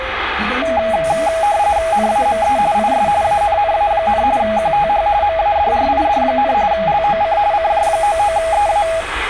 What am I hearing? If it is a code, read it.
RTTY (45.45 baud, 170 Hz shift), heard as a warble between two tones, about 740 Hz centre, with radio static and the noise inside a bus. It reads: NAME IS ANNA, QTH MADRID, LOC CJ99EA